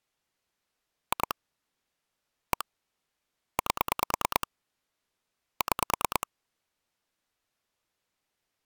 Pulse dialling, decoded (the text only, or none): 2 1 8 6